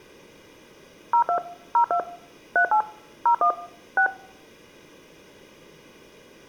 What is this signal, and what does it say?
DTMF, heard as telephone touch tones, dialled by machine, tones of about 90 ms. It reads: 02 02 38 01 6